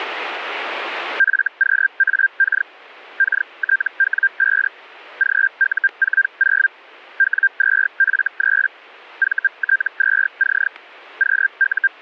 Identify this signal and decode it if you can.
Hellschreiber (Feld-Hell, 122.5 baud), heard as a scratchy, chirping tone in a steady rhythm, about 1600 Hz, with static crashes. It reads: FQAK KTW5 GU40 W2F3 VT2C …